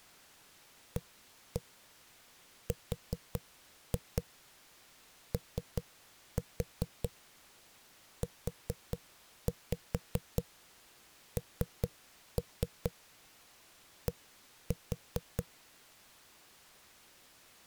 Tap code, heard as knocks on a wall, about 4 knocks a second. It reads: AROUND